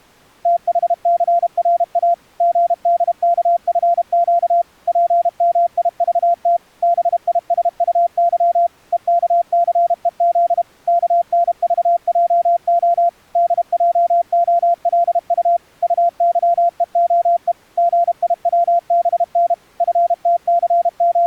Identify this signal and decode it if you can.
Morse code, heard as a keyed tone, machine-sent, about 32 wpm, 690 Hz. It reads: THCRA GDKFQ PMIVT BISUY EKCEZ KNVJO DJOLU UYEOE GIWBN …